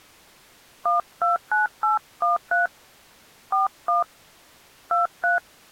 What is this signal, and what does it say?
DTMF, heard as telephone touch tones, dialled by hand, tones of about 140 ms. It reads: 129813 41 23